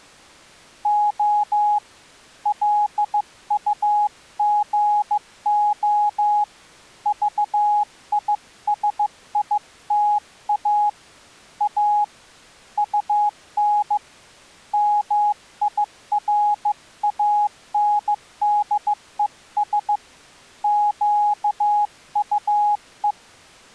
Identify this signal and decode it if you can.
Morse code, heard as a keyed tone, hand-sent with a bug key, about 15 wpm, 830 Hz. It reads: O LUGO VISITA A UN MIRANDES QUE